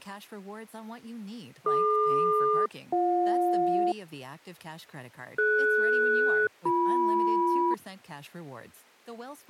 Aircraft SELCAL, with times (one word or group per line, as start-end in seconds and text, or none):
1.7-3.9 DQ-BJ
5.4-7.7 DS-BM